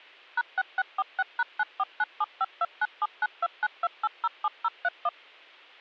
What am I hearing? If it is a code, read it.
DTMF, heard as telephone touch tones, dialled by machine, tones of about 40 ms. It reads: #6646#949752979292807031